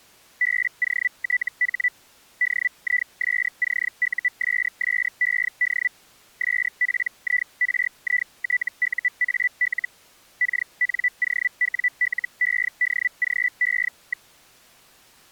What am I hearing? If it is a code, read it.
Hellschreiber (Feld-Hell, 122.5 baud), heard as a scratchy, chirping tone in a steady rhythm, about 2000 Hz. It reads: BOTH DISCUSSED SPIRITUAL KNOWLEDGE.